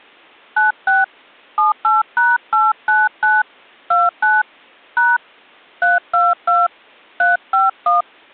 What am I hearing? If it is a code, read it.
DTMF, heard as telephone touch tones, dialled by hand, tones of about 170 ms. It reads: 96 78#899 29 # 322 351